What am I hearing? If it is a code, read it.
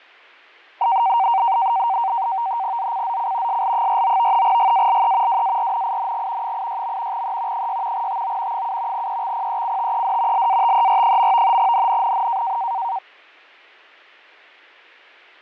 NAVTEX (SITOR-B), 100 baud, 170 Hz shift, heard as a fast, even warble, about 850 Hz centre, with fading. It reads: ZCZC SL49 GALE WARNING 86. E 6 TO 7 EXPECTED LATER. NNNN